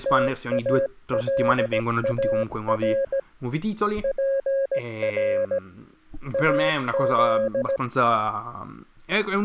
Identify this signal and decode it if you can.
Morse code (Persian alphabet), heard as a keyed tone, hand-sent with a bug key, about 17 wpm, 540 Hz, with speech in Italian. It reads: تالار پر از